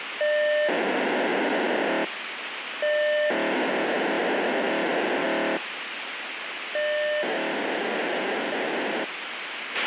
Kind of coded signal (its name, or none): POCSAG pager data